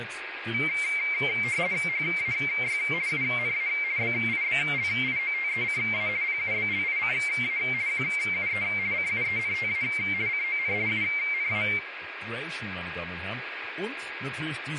RTTY (50 baud, 170 Hz shift), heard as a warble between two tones, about 2200 Hz centre, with radio static, a steady whistle near 1640 Hz and speech in German. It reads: HAY UNA BIBLIOTECA PUBLICA QUE CUENTA CON UNA